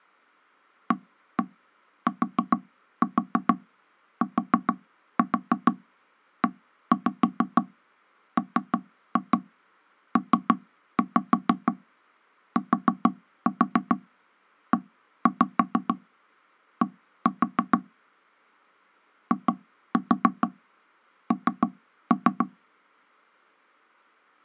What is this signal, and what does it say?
Tap code, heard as knocks on wood, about 6 knocks a second. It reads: ATTEMPTED IN